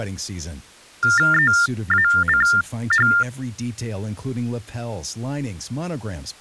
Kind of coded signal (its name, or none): TTY/TDD text telephone tones